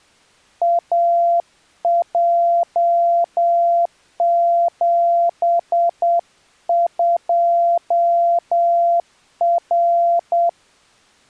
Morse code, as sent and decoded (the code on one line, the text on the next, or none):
.- .--- --... ..--- .-.
AJ72R